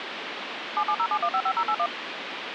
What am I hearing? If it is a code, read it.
DTMF, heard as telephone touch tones, dialled by machine, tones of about 70 ms, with phone line noise. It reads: 7707155081